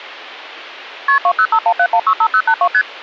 Multi-frequency trunk signalling (R1, as on North American trunks), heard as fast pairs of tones, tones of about 70 ms. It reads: KP 20517165082 ST